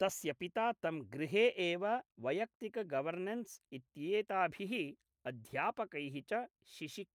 Speech in Sanskrit. There is no code.